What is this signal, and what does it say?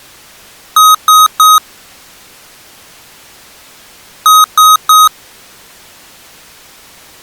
Beep code, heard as beeps from a small speaker, played twice, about 1260 Hz. 3 short. In AMI BIOS tables: failure in the first 64 KB of memory; in Dell tables: chipset error.